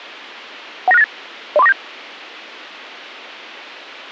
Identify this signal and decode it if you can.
Five-tone selective call (EIA), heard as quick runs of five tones, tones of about 30 ms. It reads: 19698 03497